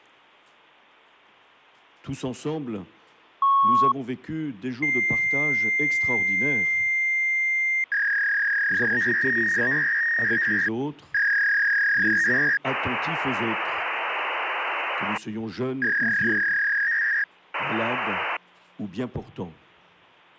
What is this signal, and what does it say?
Fax machine handshake, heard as a beep, a long tone, a warble and hiss.